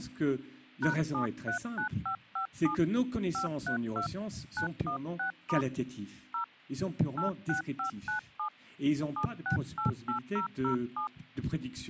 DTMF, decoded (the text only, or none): #739557 532 916* 0 86597 7688007